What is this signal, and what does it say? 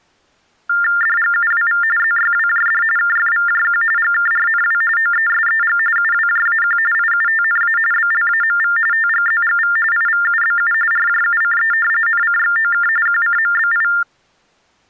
TTY/TDD text telephone tones (45.45 baud Baudot), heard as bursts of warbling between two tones, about 400 Hz shift, 1600 Hz centre. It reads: DGUWV ZYWJD KFVJQ GKRNW OESEG UWJAQ IUTNA BLAMV TGZGV IVUBU RJUCE NCXOK QCMBI